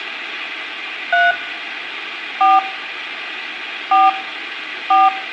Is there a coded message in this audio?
Yes: DTMF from 1.1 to 5.1 s, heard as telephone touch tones, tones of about 190 ms, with phone line noise and room echo. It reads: 3 4 4 4